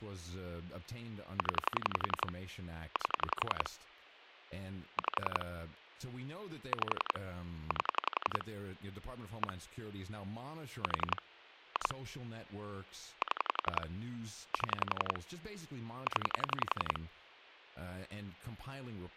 Pulse dialling, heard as clicks on a phone line, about 11 pulses a second, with speech in English. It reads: 0 8 5 5 8 1 4 2 7 7 0